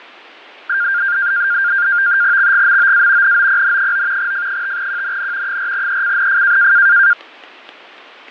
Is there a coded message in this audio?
Yes: NAVTEX (SITOR-B), 100 baud, 170 Hz shift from 0.7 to 7.1 s, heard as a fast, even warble, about 1500 Hz centre, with fading. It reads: XGMOA NOPN9 F5QNN 4ECNF